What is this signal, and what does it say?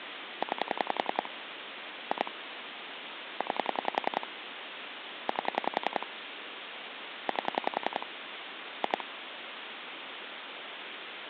Pulse dialling, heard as clicks on a phone line, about 10 pulses a second, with phone line noise. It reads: 9 2 9 8 8 2